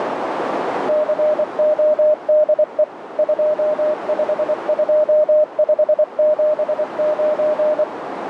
Morse code, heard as a keyed tone, machine-sent, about 24 wpm, 610 Hz, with radio static and a narrow filter. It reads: CODE 252579